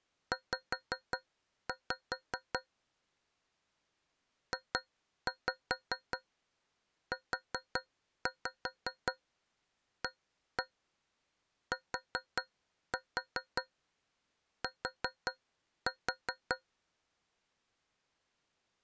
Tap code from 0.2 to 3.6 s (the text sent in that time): Z